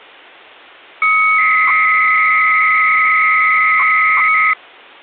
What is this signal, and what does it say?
300-baud modem data (Bell 103 tones), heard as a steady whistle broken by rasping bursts, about 300 baud, 200 Hz shift.